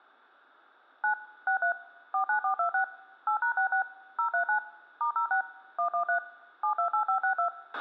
DTMF, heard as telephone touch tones, dialled by machine, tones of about 100 ms, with a squelch burst at the end. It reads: 9 63 49426 8#66 039 *06 113 728562